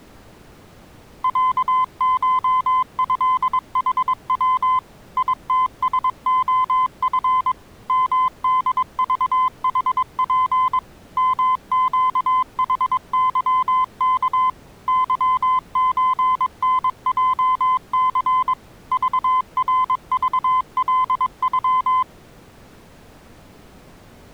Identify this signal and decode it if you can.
Morse code (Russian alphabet), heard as a keyed tone, machine-sent, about 22 wpm, 1020 Hz. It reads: ЯШЭХВ ИТСОФ МДЖХП МЩХЫК ЫЧНЙЦ ЖРЖЛЮ